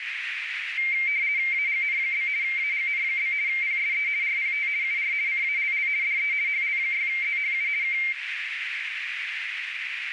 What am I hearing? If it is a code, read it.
RTTY (50 baud, 170 Hz shift), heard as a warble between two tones, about 2200 Hz centre, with radio static and a narrow filter. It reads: AGN? AGN? PSE RPT UR CALL DE HL6ZHU K